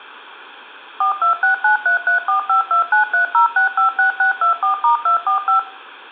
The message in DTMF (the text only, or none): 426933452930656624*245